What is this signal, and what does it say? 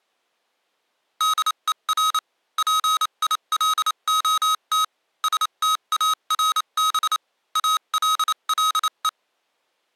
Morse code, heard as electronic beeps, machine-sent, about 28 wpm, spaced as for 25 wpm, 1270 Hz. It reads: DER PILOT STARB ALLE